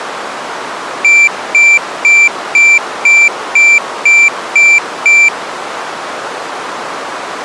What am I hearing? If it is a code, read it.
Beep code, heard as a piezo beeper, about 2350 Hz. 9 short. In AMI BIOS tables: ROM checksum failure.